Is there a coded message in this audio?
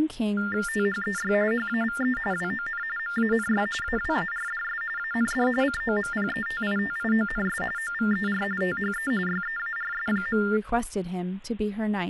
Yes: TTY/TDD text telephone tones (45.45 baud Baudot) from 0.4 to 10.6 s, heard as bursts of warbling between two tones, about 400 Hz shift, 1600 Hz centre, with speech in English. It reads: THEY HAVE WON MANY AWARDS AND COMPETITIONS OVER THE YEARS.